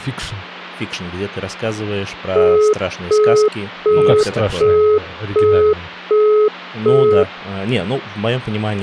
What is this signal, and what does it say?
Telephone call progress tone (as in the UK, Australia and similar networks), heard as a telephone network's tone, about 420 Hz, 0.375 s on and 0.375 s off, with hum and speech in Russian. Busy tone.